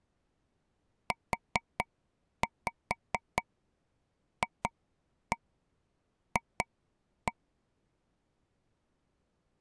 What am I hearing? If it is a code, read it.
Tap code, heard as taps on a table, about 4 knocks a second. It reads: UFF